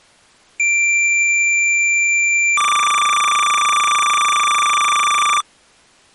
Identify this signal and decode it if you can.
Cassette data (Kansas City type), 300 baud, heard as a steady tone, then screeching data.